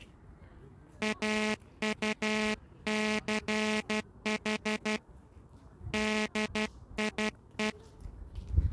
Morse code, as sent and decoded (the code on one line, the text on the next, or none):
.- ..- -.-. .... / -.. .. .
AUCH DIE